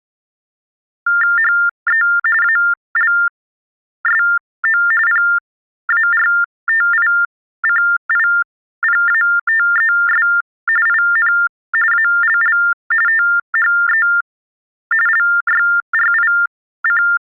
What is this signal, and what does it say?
TTY/TDD text telephone tones (45.45 baud Baudot), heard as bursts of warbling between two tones, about 400 Hz shift, 1600 Hz centre. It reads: HE ALSO PARTICIPATES IN ALL THE LYRIC